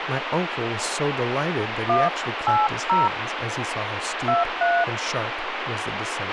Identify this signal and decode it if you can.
DTMF, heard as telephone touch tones, dialled by hand, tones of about 220 ms, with radio hiss, a squelch burst at the end and speech in English. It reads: 180 23